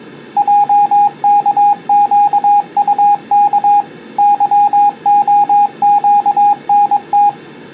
Morse code, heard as a keyed tone, machine-sent, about 22 wpm, 820 Hz. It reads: JKQUK YOQNT